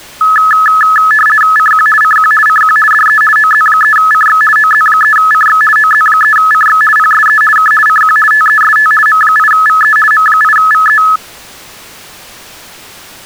RTTY (50 baud, 450 Hz shift), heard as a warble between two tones, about 1500 Hz centre. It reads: CQ CQ CQ DE OZ3CX OZ3CX OZ3CX PSE K CQ TEST M8VE M8VE